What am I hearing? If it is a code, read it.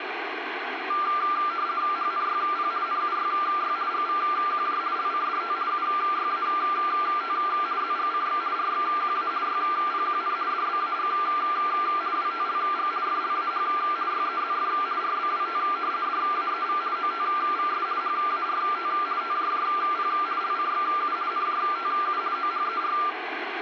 RTTY (50 baud, 170 Hz shift), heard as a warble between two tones, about 1280 Hz centre, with radio static. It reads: HNYP NUYY GVQJ LCDT UYAT ZGCX RXQA YPQN DBAG WTLG FLAH YEZF RBWT DAEV OTVS HART TJJP LCXU NJTU OHER